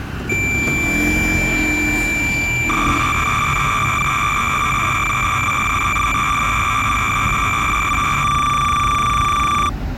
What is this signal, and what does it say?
Cassette data (Kansas City type), 300 baud, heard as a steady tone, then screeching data, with street noise.